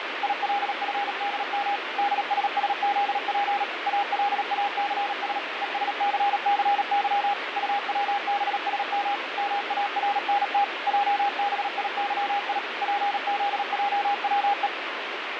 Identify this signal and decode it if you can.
Morse code, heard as a keyed tone, machine-sent, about 37 wpm, 810 Hz, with radio static. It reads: ILFDM DSSZP ALACS ESCCY UWBSM MARNT JBIYI PZJWE